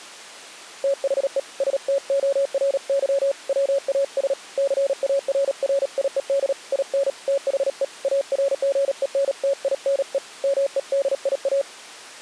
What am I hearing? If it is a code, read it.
Morse code, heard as a keyed tone, hand-sent with a paddle, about 37 wpm, 550 Hz. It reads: THE STORY WAS CARRIED IN THE ARGENTINE MEDIA